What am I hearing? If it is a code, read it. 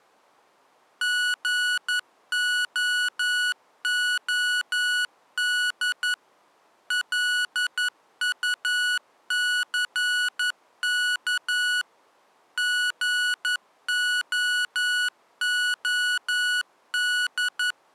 Morse code, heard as electronic beeps, machine-sent, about 11 wpm, 1470 Hz. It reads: GOOD LUCK GOOD